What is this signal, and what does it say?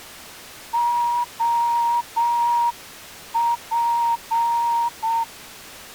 Morse code, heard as a whistle, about 7 wpm. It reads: OP